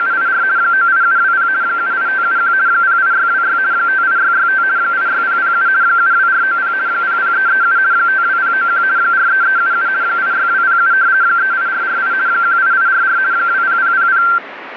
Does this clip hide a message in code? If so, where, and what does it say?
Yes: RTTY (50 baud, 170 Hz shift) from 0.0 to 14.4 s, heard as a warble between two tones, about 1470 Hz centre, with radio static. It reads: … 98720 78571 08626 58665 86007 72490 00337 52091 43377 86207 38448 18844 20000